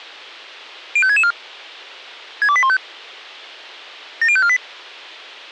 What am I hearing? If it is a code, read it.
Five-tone selective call (ZVEI), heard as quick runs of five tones, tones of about 70 ms. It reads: 05664 62815 70548